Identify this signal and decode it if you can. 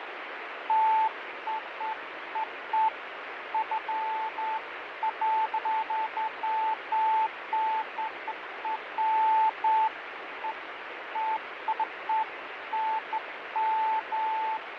Beeps of irregular length, with radio static and fading. There is no code.